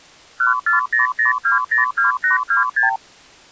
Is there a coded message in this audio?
Yes: multi-frequency trunk signalling (R2, with the far end's replies) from 0.4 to 3.0 s, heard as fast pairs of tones, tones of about 130 ms. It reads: 1400202826